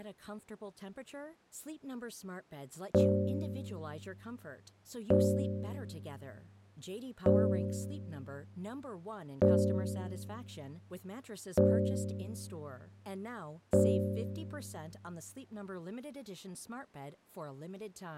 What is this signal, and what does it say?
Clock strike, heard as a bell, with speech in English. 6. Six o'clock.